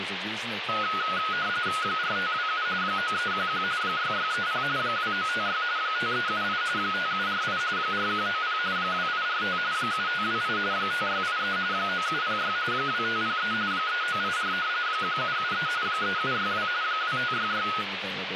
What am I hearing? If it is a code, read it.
RTTY (45.45 baud, 170 Hz shift), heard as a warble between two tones, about 1360 Hz centre, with radio static and speech in English. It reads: 4527 9311 6630 2956 5378 5748 4190 2845 7528 5683 9706 2503 3984 1773 3762 2566